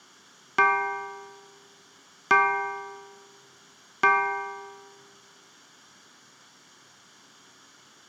Clock strike, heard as a bell, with room echo. 3. Three o'clock.